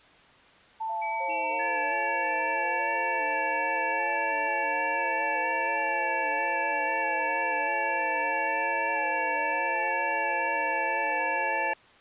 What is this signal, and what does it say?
FT8 (several signals at once), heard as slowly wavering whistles, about 6.25 baud.